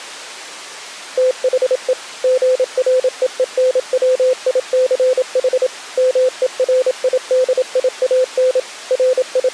Morse code, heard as a keyed tone, machine-sent, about 27 wpm, 510 Hz. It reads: THE GREENWICH MERIDIAN …